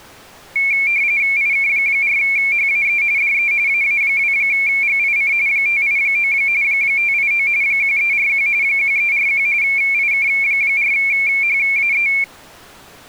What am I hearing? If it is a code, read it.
RTTY (45.45 baud, 170 Hz shift), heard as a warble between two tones, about 2300 Hz centre. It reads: IK4HAE DE AA2GIC 589 589 1341 1341 IK4HAE